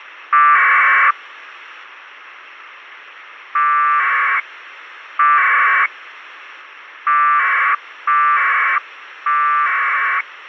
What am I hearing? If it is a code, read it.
Packet radio (AX.25, as in APRS), 1200 baud, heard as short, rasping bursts, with radio hiss.